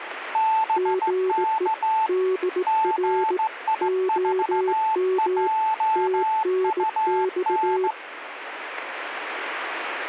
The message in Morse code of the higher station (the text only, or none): BK GI4JUN